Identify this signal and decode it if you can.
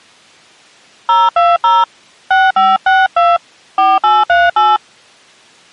DTMF, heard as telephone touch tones, dialled by hand, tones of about 200 ms. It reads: 020 6562 4838